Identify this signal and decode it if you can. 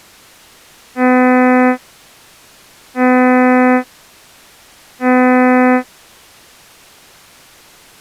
Ship horn signal, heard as a ship's horn, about 250 Hz. 3 short. At sea: I am operating astern propulsion.